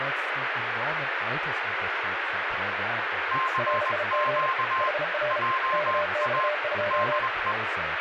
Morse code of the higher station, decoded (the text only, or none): CQ JA DE